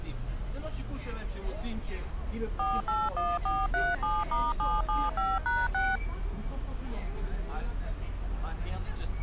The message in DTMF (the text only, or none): 481437*775#6